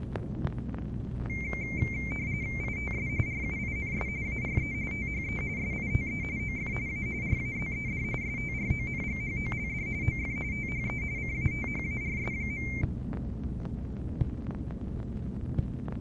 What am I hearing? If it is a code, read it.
RTTY (45.45 baud, 170 Hz shift), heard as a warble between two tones, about 2200 Hz centre. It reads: ITS RUINS ARE THE SITE OF A RAZED STRONGHOLD OF THE CATHARS.